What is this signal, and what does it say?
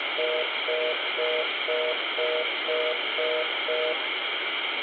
Telephone call progress tone (North American plan), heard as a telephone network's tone, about 480, 620 Hz, 0.25 s on and 0.25 s off, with phone line noise and room echo. Congestion tone.